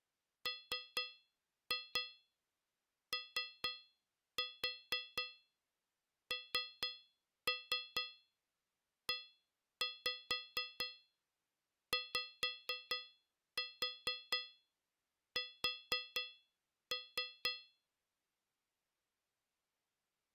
Tap code, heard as taps on a metal pipe, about 4 knocks a second. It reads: MONEYS